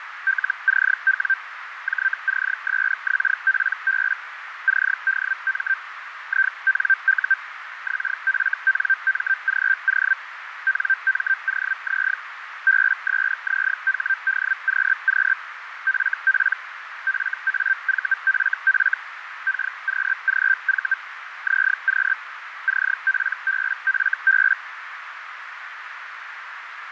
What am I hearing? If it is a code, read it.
Hellschreiber (Feld-Hell, 122.5 baud), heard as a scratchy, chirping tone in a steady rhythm, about 1550 Hz, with radio static and a narrow filter. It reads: LCW JCSXPB CDM INU XFNMGO NMOZ BSZHDQQ FP FAVFF KQGV ZQ CPBFB